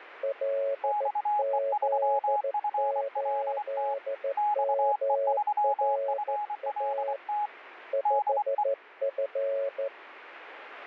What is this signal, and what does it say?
Morse code, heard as two keyed tones, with radio static. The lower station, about 14 wpm, 550 Hz: LZ8MRA 5F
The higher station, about 24 wpm, 840 Hz: XE3FLT XE3FLT DE